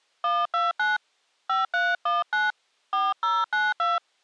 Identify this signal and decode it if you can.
DTMF, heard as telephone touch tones, dialled by hand, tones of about 180 ms. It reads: 129 5319 4092